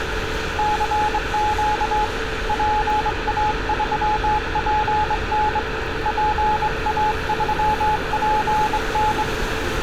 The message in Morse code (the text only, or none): CQ PA3PN PA3PN